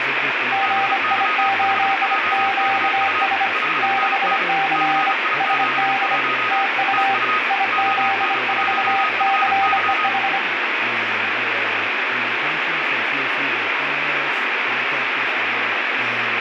Morse code, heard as two keyed tones, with radio static and speech in English. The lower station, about 25 wpm, 780 Hz: GI8QS 6C SD TU IZ4CEH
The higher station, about 35 wpm, 1250 Hz: BY5JKU 5NN CI71 TU ON1FY